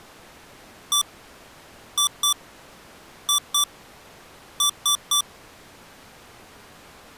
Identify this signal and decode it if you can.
Beep code, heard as beeps from a small speaker, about 1160 Hz. 1-2-2-3. In Phoenix BIOS tables: BIOS ROM checksum failure.